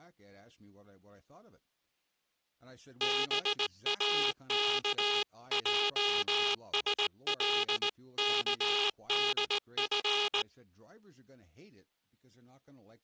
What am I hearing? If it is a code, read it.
Morse code (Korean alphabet), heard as a buzzer, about 18 wpm, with speech in English. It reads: 동혁은